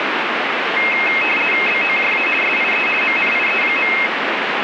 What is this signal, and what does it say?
RTTY (50 baud, 450 Hz shift), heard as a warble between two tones, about 2350 Hz centre, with radio static. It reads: BOJA SIE MNIE.